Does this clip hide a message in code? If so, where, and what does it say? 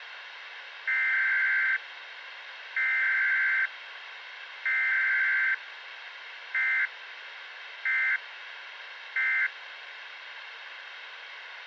Yes: Emergency Alert System (SAME) tones (header bursts, then end-of-message bursts) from 0.9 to 9.5 s, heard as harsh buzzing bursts, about 520.83 baud, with radio hiss.